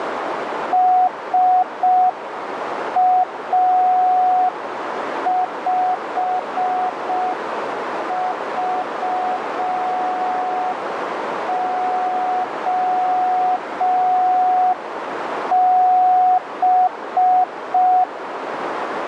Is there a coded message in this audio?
Yes: Morse code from 0.7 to 18.1 s, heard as a keyed tone, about 5 wpm, 740 Hz, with heavy radio static and a narrow filter. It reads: SA5VOB